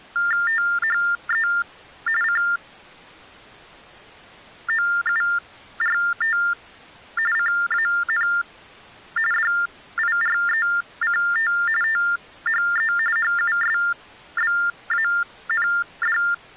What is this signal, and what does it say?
TTY/TDD text telephone tones (45.45 baud Baudot), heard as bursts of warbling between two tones, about 400 Hz shift, 1600 Hz centre. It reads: THE COURT CAN DIRECT THE HUSBAND